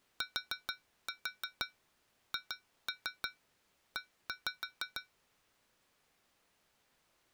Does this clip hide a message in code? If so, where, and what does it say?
Yes: tap code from 0.2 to 5.2 s, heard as taps on glass, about 6 knocks a second. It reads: THE